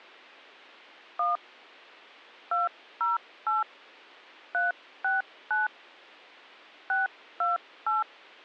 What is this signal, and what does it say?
DTMF, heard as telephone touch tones, dialled by hand, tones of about 160 ms. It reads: 1 208 369 628